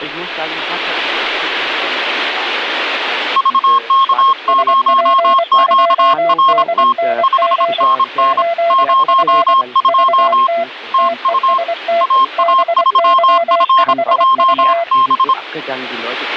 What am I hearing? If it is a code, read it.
Morse code, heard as two keyed tones. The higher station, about 26 wpm, 1070 Hz: VK0QRT 5NN 02 TU AA3FJB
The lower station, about 24 wpm, 680 Hz: SP2DNG 8F VT TEST BY5V